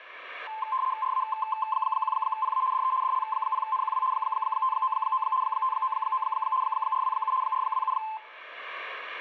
RTTY (75 baud, 170 Hz shift), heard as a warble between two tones, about 960 Hz centre. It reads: RA1PA DE DL0NQW 599 599 427 427